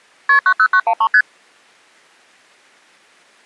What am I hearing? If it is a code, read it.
Multi-frequency trunk signalling (R1, as on North American trunks), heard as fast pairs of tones, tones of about 70 ms. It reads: KP 90913 ST